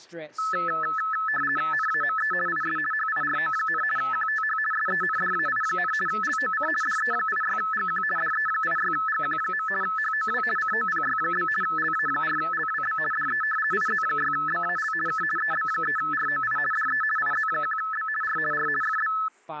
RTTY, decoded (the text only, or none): NAME IS HIRO, QTH SENDAI, LOC DE86GQ DE86GQ. HOW COPY? LA4LWB DE IZ6BAL K EB3ROI DE IZ1B R R FB